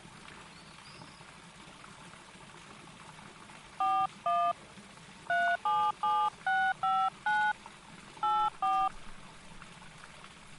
DTMF, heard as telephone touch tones, dialled by hand, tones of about 260 ms. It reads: 41 377659 84